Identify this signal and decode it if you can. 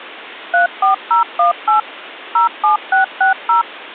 DTMF, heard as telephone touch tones, dialled by machine, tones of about 130 ms. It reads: 34018 07660